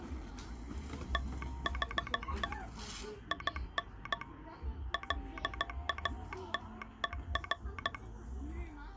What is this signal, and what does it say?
Morse code, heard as a telegraph sounder, hand-sent with a paddle, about 15 wpm, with the noise of a park. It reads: THE IN LATER